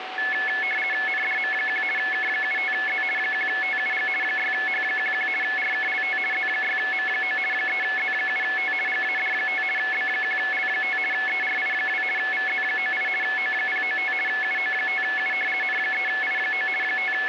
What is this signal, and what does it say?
RTTY (50 baud, 450 Hz shift), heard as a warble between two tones, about 1950 Hz centre, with radio static and a steady whistle near 750 Hz. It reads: NDM1 K75Z 1TUG 6H11 RKLT Z6M9 3Z7T GAD5 B1L5 ERI2 VZ98 O095 UO5U N3I9 …